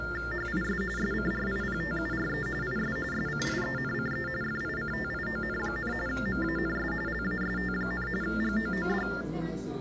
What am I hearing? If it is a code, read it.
TTY/TDD text telephone tones (45.45 baud Baudot), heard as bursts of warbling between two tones, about 400 Hz shift, 1600 Hz centre, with the noise of a crowd indoors. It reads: HIS SCRIPTURE IS SCIENCE FICTION, MANS LAST, GOOD